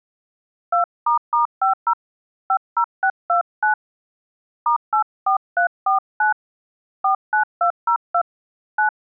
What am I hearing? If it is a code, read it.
DTMF, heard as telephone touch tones, dialled by hand, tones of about 100 ms. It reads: 2**50 50629 *84349 49202 9